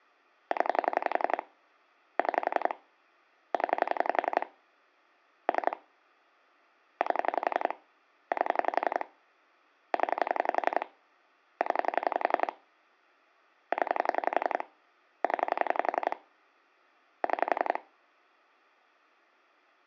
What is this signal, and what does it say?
Pulse dialling, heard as clicks on a phone line, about 11 pulses a second. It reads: 0 6 0 3 8 8 0 0 0 0 6